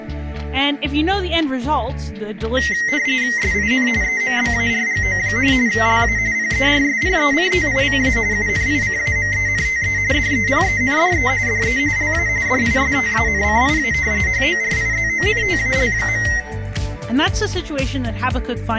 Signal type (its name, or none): RTTY